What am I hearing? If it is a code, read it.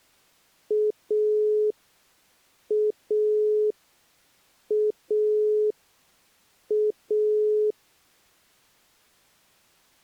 Telephone call progress tone (pulsed, as in Italy), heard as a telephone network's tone, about 420 Hz. Dial tone.